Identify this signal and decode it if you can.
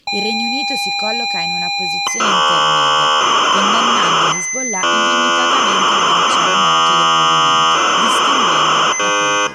ZX Spectrum tape loading, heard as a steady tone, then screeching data, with room echo and speech in Italian.